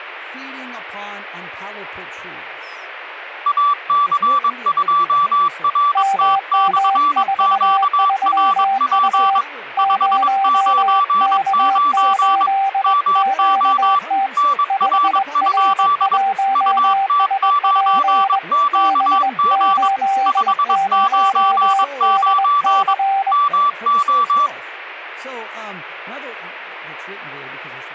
Morse code, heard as two keyed tones, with speech in English. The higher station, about 22 wpm, 1160 Hz: AC2RT/QRP 599 MO NR? UT9QG 599 MO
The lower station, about 21 wpm, 780 Hz: MM43U 0K8QT 5R1SP B80DC